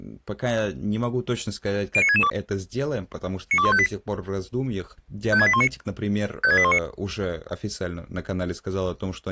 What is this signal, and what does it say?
Five-tone selective call (ZVEI), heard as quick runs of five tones, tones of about 70 ms, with speech in Russian. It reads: 09662 92158 56819 56819